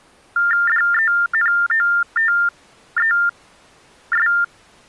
TTY/TDD text telephone tones (45.45 baud Baudot), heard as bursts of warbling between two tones, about 400 Hz shift, 1600 Hz centre. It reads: DENOTES